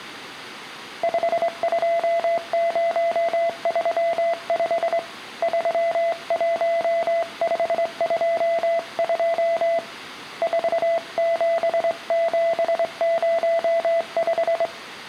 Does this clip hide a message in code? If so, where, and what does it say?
Yes: Morse code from 1.0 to 14.7 s, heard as a keyed tone, hand-sent with a straight key, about 23 wpm, 670 Hz. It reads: 52035 31522 47705